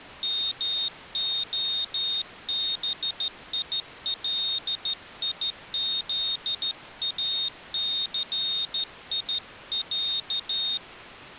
Morse code (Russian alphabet), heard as a high beeper, hand-sent with a straight key, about 13 wpm, 3700 Hz. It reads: МОБИЛИЗАЦИЯ